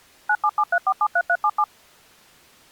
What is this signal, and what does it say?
DTMF, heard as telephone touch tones, dialled by machine, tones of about 60 ms. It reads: 9773473377